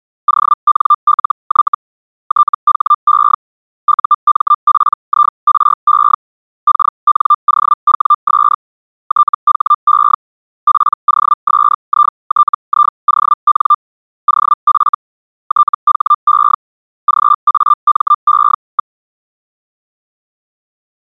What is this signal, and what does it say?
Hellschreiber (Feld-Hell, 122.5 baud), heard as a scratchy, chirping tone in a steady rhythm, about 1190 Hz. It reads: ONLY THE UMPIRE KNOWS THE POSITION OF THE GAME.